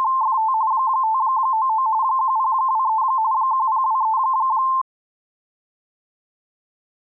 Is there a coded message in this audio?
Yes: RTTY (45.45 baud, 170 Hz shift) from 0.0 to 4.8 s, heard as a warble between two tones, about 970 Hz centre. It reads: … 599 1023 1023